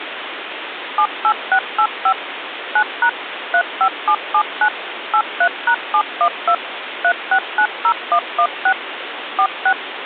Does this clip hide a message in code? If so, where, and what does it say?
Yes: DTMF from 1.0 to 9.7 s, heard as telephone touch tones, dialled by machine, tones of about 70 ms, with phone line noise. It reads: 78685 9# 35779 83#712 3690116 46